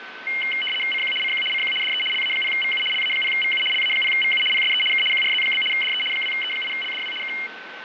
RTTY (75 baud, 850 Hz shift), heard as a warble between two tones, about 2550 Hz centre, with radio static, fading and a steady whistle near 1530 Hz. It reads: CQ CQ CQ DE LA0VU LA0VU LA0VU PSE K QRZ? DE 2E8LDW K